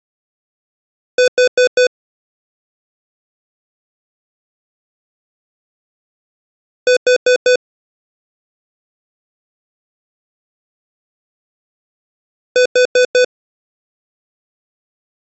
Alarm pattern, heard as an alarm's beeps, played three times, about 500 Hz. Temporal four. Carbon monoxide.